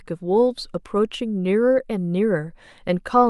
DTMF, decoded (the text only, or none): none